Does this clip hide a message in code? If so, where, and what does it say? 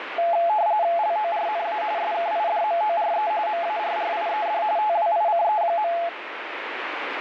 Yes: RTTY (45.45 baud, 170 Hz shift) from 0.2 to 6.1 s, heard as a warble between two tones, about 770 Hz centre, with radio static. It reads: LORNA SKIDMORE MARRIED TWICE.